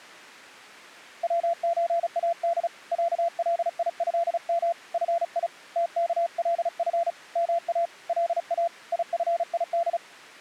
Morse code (Arabic alphabet), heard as a keyed tone, hand-sent with a paddle, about 35 wpm, 680 Hz. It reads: وزاد عليهم في تكلف ما لا يفيد